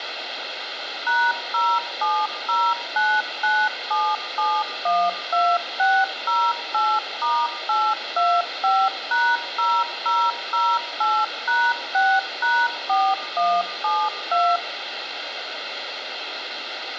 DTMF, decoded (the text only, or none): #070997712608*825#0008#6#4172